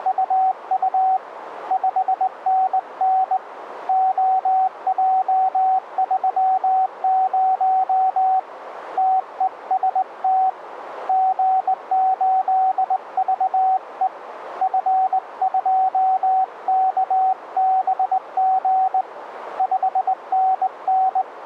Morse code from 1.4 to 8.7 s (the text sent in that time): 5NN OJ30